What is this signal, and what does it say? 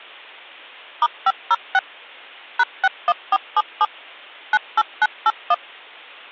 DTMF, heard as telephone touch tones, dialled by machine, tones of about 40 ms. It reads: *506 #61477 98981